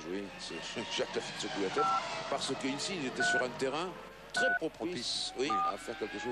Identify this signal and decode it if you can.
DTMF, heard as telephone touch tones, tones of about 210 ms, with hum. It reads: 5 3 3 4